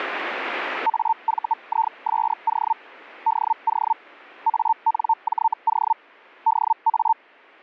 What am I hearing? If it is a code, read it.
Hellschreiber (Feld-Hell, 122.5 baud), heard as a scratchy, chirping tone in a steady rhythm, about 900 Hz. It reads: AVISO DO ANJO DA